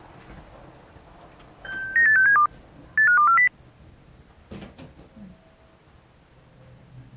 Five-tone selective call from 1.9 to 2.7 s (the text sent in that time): 98672